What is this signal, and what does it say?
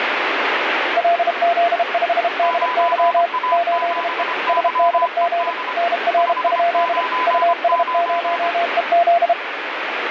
Morse code, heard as two keyed tones, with radio static. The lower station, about 32 wpm, 690 Hz: LZ5DY 8E SDG NR? US0EZ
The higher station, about 25 wpm, 1000 Hz: 9A7YED 599